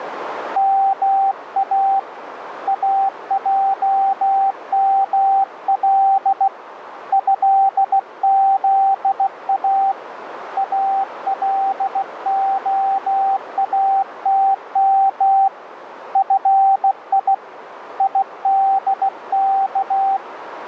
Morse code (Arabic alphabet), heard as a keyed tone, hand-sent with a bug key, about 16 wpm, 780 Hz, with radio static and a narrow filter. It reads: ما اجمل هذا الخاتم في يدك